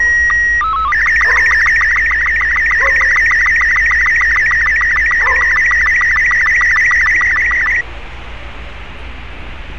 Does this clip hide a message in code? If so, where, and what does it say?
Yes: SSTV (slow-scan television), Robot 36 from 0.0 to 7.8 s, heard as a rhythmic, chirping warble, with radio static and street noise.